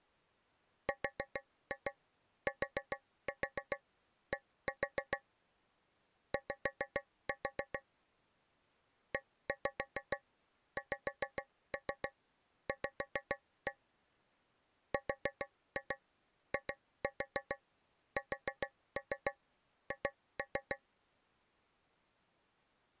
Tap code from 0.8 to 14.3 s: RTD Y EXV

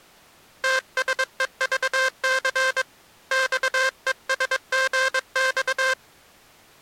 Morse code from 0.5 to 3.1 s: TSEVC

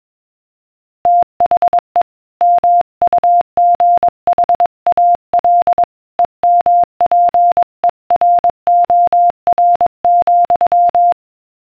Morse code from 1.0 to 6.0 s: THE MUGHAL

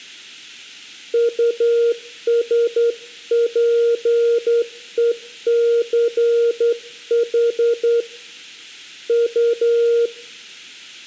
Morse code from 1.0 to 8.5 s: USPECH

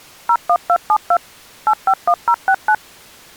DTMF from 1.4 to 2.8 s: 851069

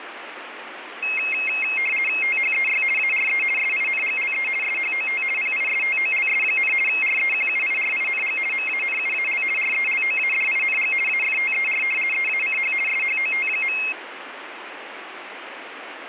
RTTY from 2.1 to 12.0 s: THEY ARE SINGLE SHOT PISTOLS, REQUIRING MANUAL RELOADING AFTER

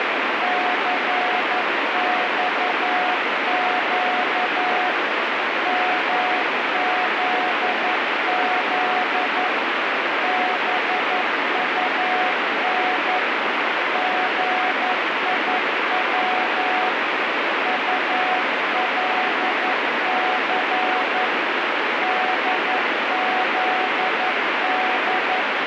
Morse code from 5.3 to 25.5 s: MZZ BUN GIW ULC DZD

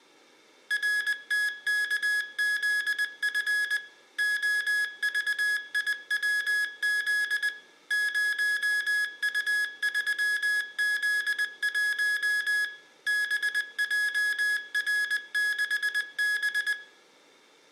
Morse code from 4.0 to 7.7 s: OVIWZ

